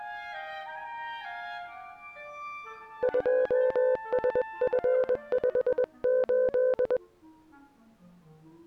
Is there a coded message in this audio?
Yes: Morse code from 3.0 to 7.0 s, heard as a keyed tone, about 21 wpm, 510 Hz. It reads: 2SF58